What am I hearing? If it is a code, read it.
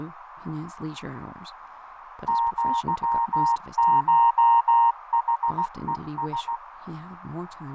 Morse code (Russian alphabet), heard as a keyed tone, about 16 wpm, 930 Hz, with radio static, fading, a narrow filter and speech in English. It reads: ЪШХЕС